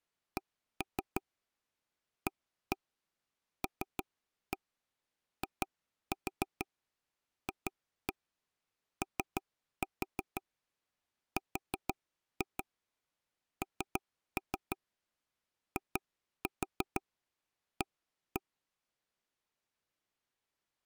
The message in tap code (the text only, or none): CALIFORNIA